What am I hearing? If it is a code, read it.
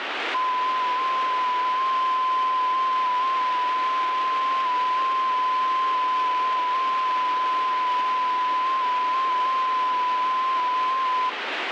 FT8 (one signal), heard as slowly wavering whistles, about 6.25 baud, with radio static.